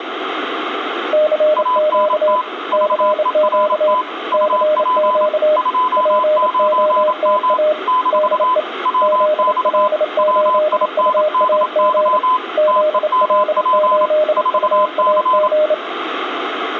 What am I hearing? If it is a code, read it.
Morse code, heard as two keyed tones, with radio static and room echo. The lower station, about 28 wpm, 610 Hz: CQ CQ CQ POTA DE ZL8UAG ZL8UAG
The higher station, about 27 wpm, 1010 Hz: ANT VERT UP 29M - WX WINDY TEMP 4C